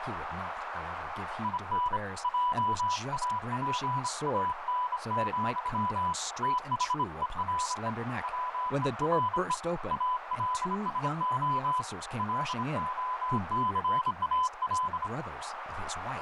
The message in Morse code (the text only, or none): IN JAPAN, THERE WERE ALSO LOCAL